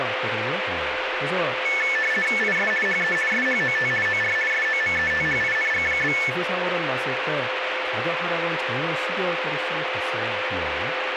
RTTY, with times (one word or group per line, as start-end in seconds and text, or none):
2.4-2.7 IS
2.9-3.2 HE
3.3-3.9 SHOT
4.1-4.4 OR
4.5-6.2 SOMETHING?